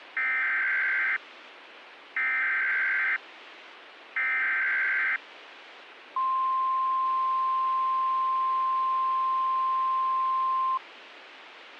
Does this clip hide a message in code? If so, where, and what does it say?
Yes: Emergency Alert System (SAME) tones (header bursts, then the 1050 Hz attention tone) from 0.2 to 10.8 s, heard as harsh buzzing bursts, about 520.83 baud, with radio hiss.